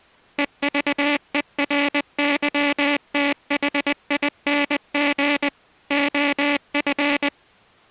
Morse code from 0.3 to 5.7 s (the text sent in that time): EVERYTHING